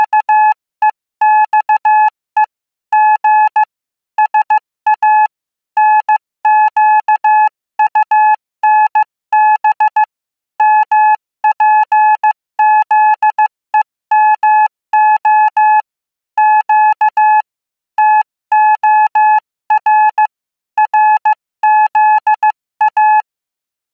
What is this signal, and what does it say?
Morse code, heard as a keyed tone, hand-sent with a paddle, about 15 wpm, 860 Hz. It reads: … G SA NQUNB MPZEMO Q TOR RZA